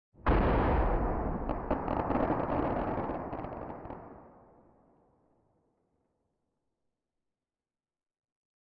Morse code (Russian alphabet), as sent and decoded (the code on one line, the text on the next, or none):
none